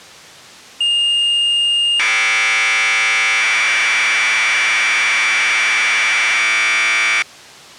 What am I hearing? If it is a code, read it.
Commodore tape loading (standard loader), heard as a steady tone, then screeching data.